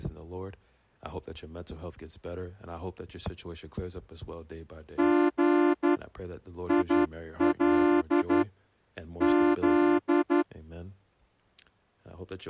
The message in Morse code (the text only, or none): G IL Z